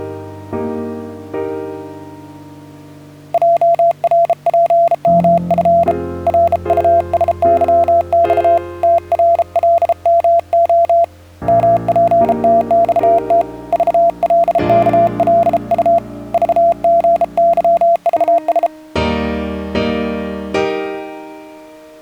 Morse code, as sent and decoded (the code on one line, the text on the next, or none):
.--- .-. .--. -- ..-. / .-. ..- ... -.-- -..- / - .-. .-.. -- --- / -- .--. - -..- - / ...- .-.. -.- .-.. ..- / ...- --. -.-- ...- ...
JRPMF RUSYX TRLMO MPTXT VLKLU VGYVS